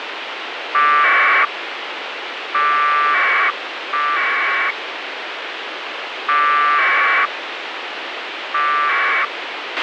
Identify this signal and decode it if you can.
Packet radio (AX.25, as in APRS), 1200 baud, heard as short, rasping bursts, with radio hiss and a squelch burst at the end.